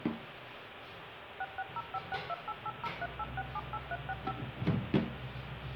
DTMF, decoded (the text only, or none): 66056288038678365